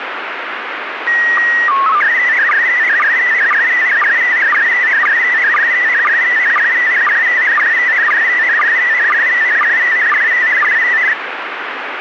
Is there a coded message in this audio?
Yes: SSTV (slow-scan television), PD 120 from 1.1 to 11.1 s, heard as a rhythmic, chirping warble, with radio static.